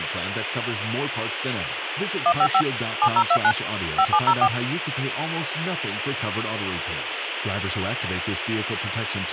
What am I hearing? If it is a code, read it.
DTMF, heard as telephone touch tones, dialled by machine, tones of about 70 ms, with phone line noise and speech in English. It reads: 155 7029 5704